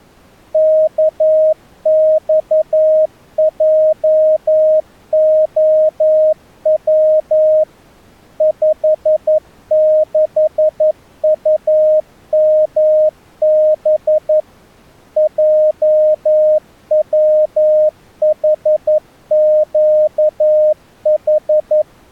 Morse code, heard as a keyed tone, machine-sent, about 11 wpm, 620 Hz. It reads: KXJOW 56UMB JWHQH